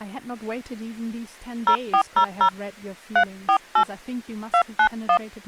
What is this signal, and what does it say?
DTMF, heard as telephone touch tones, dialled by hand, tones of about 80 ms, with speech in English. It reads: 0400 348 291